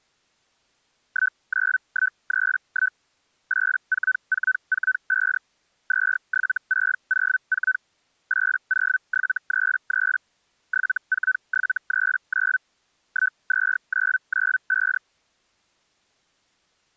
Hellschreiber (Feld-Hell, 122.5 baud), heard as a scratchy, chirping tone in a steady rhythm, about 1500 Hz. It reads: 19131 84445 27604 80733 74739 12995